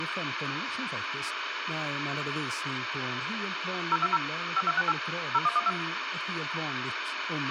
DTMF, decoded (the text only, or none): 020 5268 0112